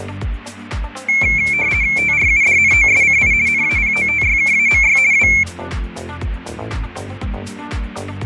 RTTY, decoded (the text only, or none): TRUDNOSCI NAPOTYKAMY W